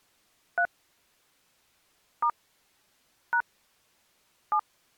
DTMF, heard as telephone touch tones, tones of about 80 ms. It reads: 3 * # 7